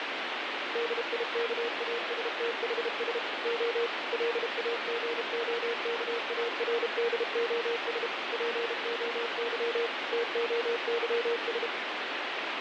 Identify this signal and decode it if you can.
Morse code (Greek alphabet), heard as a keyed tone, machine-sent, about 32 wpm, 470 Hz, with radio static. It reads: ΔΙΚΑΣΤΗΣ Ο ΛΑΓΟΚΑΡΔΟΣ ΠΟΥ ΤΟΥΣ